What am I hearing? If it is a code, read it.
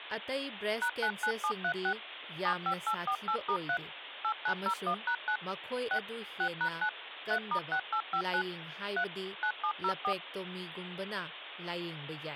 DTMF, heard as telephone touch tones, dialled by machine, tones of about 80 ms, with phone line noise and speech in Manipuri. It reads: #99736 75848*3 8901#9 6 6#9 3*6859 3 9704